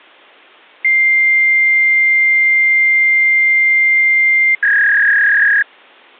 Fax machine handshake, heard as a long tone and a warble.